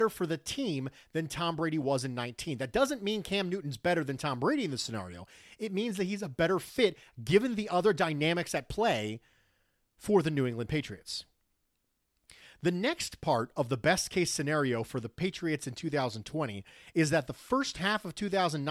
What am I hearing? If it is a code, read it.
Speech in English. There is no code.